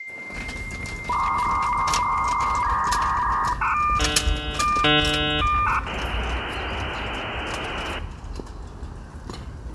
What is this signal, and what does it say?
Dial-up modem handshake (V.34 or later), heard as a whistle, warbles, then hiss, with room echo and the noise of a residential street.